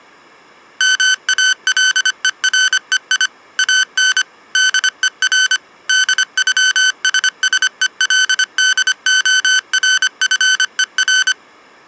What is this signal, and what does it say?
Morse code (with German letters), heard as electronic beeps, machine-sent, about 25 wpm, 1500 Hz. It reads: MALEREI AN DER DÜSSELDORFER